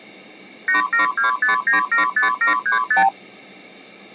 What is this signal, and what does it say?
Multi-frequency trunk signalling (R2, with the far end's replies), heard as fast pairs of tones, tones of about 120 ms. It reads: 8725975735